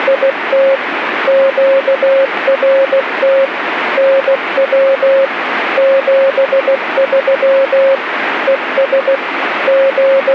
Morse code, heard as a keyed tone, machine-sent, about 16 wpm, 540 Hz, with radio static. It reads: … QRT NW 73 ES …